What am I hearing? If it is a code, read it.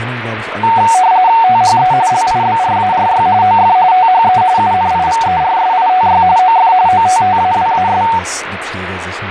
RTTY (45.45 baud, 170 Hz shift), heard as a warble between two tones, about 830 Hz centre, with radio static and speech in German. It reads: THE LIBRARY OF THE UNIVERSITY OF OTTAWAS